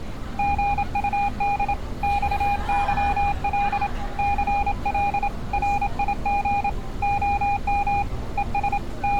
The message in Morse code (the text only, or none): GUD XYL CL RIG OM ES …